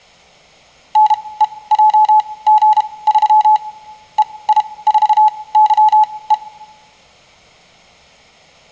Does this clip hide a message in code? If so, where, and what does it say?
Yes: Morse code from 0.9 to 6.4 s, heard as a keyed tone, machine-sent, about 32 wpm, spaced as for 21 wpm, 860 Hz, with room echo. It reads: NEJG3 EI4YE